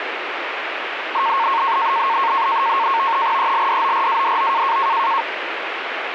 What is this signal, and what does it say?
NAVTEX (SITOR-B), 100 baud, 170 Hz shift, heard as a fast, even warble, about 1000 Hz centre, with radio static. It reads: ELDORADO